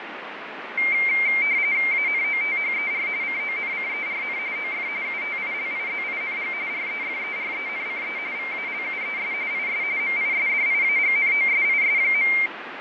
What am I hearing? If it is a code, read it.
RTTY (45.45 baud, 170 Hz shift), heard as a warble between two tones, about 2200 Hz centre, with radio static and fading. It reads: ANOTHER CONCERN OF UTILIZING REFERENCE VALUES IS MISDIAGNOSIS.